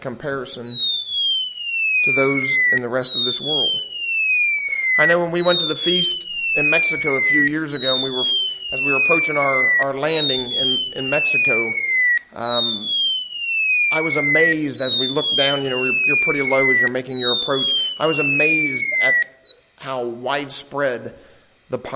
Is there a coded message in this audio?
No, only a tone that sweeps in pitch again and again.